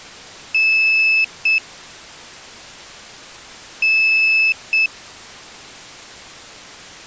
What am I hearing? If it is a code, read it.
Beep code, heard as a piezo beeper, played twice, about 2600 Hz. 1 long, 1 short. In IBM BIOS tables: system board problem.